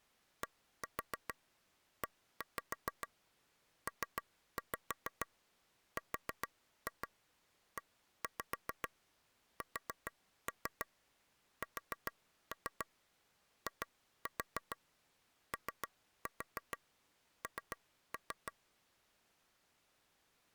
Tap code, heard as taps on a table, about 6 knocks a second. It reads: DEPRESSION